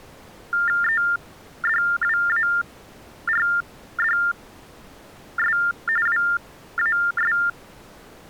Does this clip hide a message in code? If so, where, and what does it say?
Yes: TTY/TDD text telephone tones (45.45 baud Baudot) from 0.5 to 7.5 s, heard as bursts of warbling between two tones, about 400 Hz shift, 1600 Hz centre. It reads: EDWARDS WAS